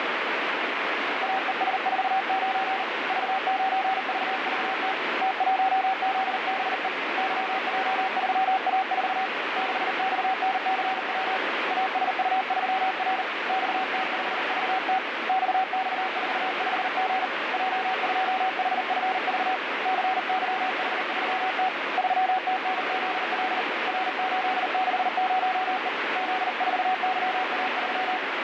Morse code, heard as a keyed tone, hand-sent with a paddle, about 39 wpm, 760 Hz, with heavy radio static. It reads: AES49 V9VVT T1ZBE YJ3A4 6XNCW ASU3R XT5VT XX45G J2HFV CYH3T 3TNZL R860E Z4YA3